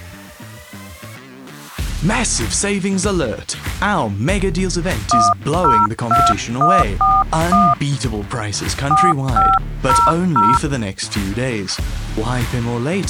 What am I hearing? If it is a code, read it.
DTMF, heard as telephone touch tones, dialled by hand, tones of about 220 ms. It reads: 102141 4500